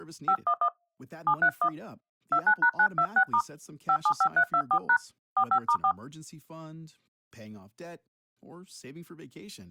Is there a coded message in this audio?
Yes: DTMF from 0.3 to 5.9 s, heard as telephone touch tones, dialled by hand, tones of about 70 ms. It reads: 511 731 29#926* 575324# 45*4